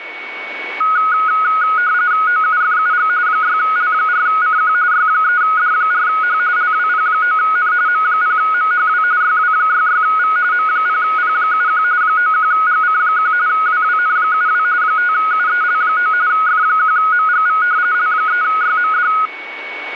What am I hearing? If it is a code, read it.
RTTY (45.45 baud, 170 Hz shift), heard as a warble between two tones, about 1360 Hz centre, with radio static and a steady whistle near 2230 Hz. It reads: OUFUG 6L4CQ Y3D4H LWP9N M0MHW YW66V M0P71 91GC1 WWN72 5UEL9 F1MGV L3YMD